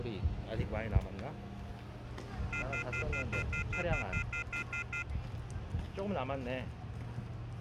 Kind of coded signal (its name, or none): telephone call progress tone